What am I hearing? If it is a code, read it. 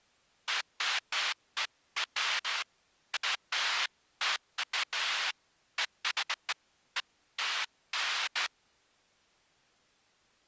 Bursts of noise. There is no code.